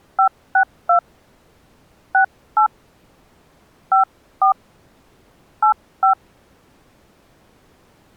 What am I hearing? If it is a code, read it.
DTMF, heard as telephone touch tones, dialled by hand, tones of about 100 ms. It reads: 562 68 54 85